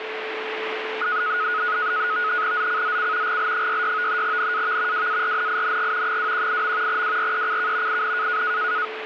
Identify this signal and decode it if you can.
NAVTEX (SITOR-B), 100 baud, 170 Hz shift, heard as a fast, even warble, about 1360 Hz centre, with radio static and a steady whistle near 440 Hz. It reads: ZCZC GL66 NAV WARNING 218. WRECK IN